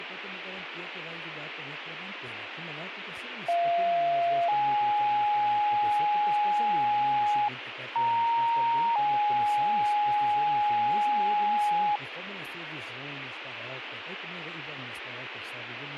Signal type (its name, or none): two-tone page